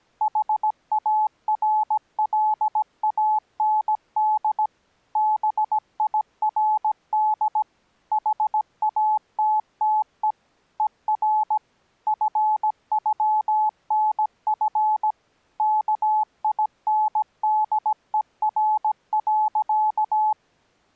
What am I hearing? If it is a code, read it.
Morse code (with German letters), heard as a keyed tone, machine-sent, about 17 wpm, 860 Hz. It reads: HARLAND BIRD HATTE ER FÜNF KINDER.